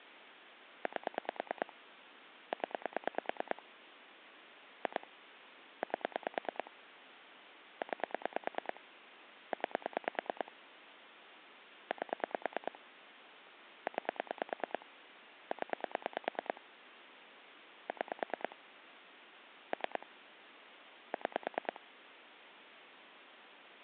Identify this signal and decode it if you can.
Pulse dialling, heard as clicks on a phone line, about 9 pulses a second, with phone line noise. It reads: 8 0 2 8 9 9 8 9 0 6 3 6